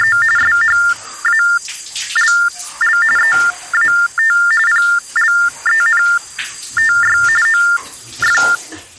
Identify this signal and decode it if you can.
TTY/TDD text telephone tones (45.45 baud Baudot), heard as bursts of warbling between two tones, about 400 Hz shift, 1600 Hz centre, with the noise of a restroom. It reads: … SHALL EAT PLENTY OF